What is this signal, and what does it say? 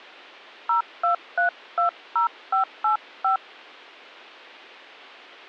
DTMF, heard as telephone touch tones, dialled by hand, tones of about 120 ms. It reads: 02320585